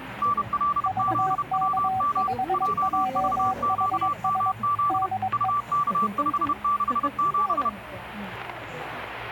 Morse code, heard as two keyed tones, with the noise of a cafe. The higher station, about 31 wpm, 1160 Hz: NLZWM JVQMZ UK567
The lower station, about 22 wpm, 760 Hz: VK5JHS DE